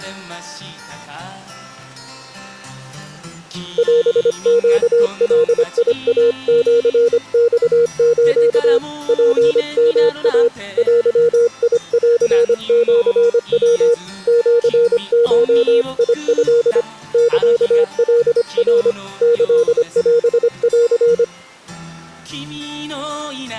Morse code (Japanese Wabun code), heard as a keyed tone, hand-sent with a paddle, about 25 wpm, 470 Hz. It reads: オネガイシマス ツヨイ デンシヤ シゴト サカナ キオン